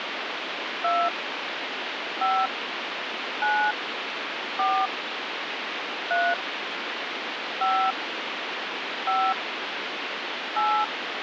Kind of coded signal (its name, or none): DTMF